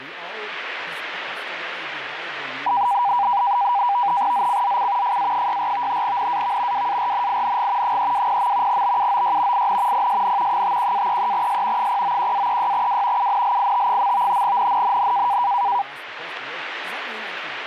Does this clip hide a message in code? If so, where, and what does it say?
Yes: NAVTEX (SITOR-B), 100 baud, 170 Hz shift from 2.7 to 15.8 s, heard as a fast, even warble, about 890 Hz centre, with radio static. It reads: ZCZC FA64 NAV WARNING 320. BUOY IN PSN 51-33S 091-36W UNLIT. NNNN